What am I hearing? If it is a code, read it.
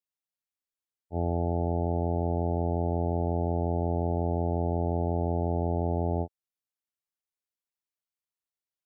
Ship horn signal, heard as a ship's horn, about 90 Hz. 1 long. At sea: a vessel nearing a blind bend, or under power and making way in fog.